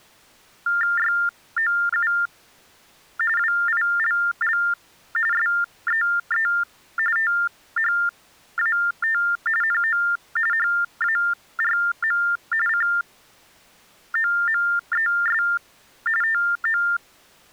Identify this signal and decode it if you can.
TTY/TDD text telephone tones (45.45 baud Baudot), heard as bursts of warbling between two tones, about 400 Hz shift, 1600 Hz centre. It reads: YOU WILL SEE THAT NO HARM COMES TO